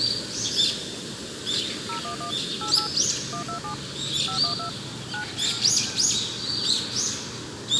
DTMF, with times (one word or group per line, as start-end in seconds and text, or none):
1.9-2.3 011
2.6-2.9 88
3.3-3.7 127
4.3-4.7 512
5.1-5.2 9